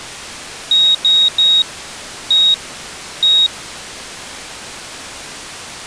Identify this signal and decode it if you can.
Beep code, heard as a piezo beeper, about 3800 Hz. 3-1-1. In Phoenix BIOS tables: DMA register failure.